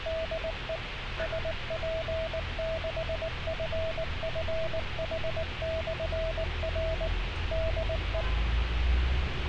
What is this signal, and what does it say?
Morse code, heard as a keyed tone, machine-sent, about 19 wpm, 650 Hz, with radio hiss and street noise. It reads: DE SP6FFH/R DE